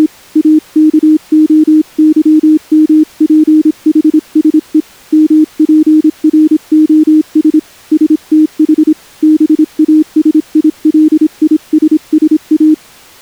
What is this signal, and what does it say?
Morse code (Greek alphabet), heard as a keyed tone, hand-sent with a paddle, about 26 wpm, 310 Hz. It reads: … ΑΚΟΥΜΠΗΣΕ ΜΠΡΟΣ ΣΤΗ ΒΑΣΙΛΙΣΣΑ